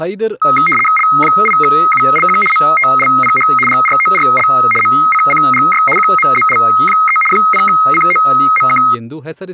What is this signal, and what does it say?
RTTY (75 baud, 850 Hz shift), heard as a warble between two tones, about 1700 Hz centre, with speech in Kannada. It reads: L8ULQ MTLPH GRORL MCCGY QMZL3 0COMK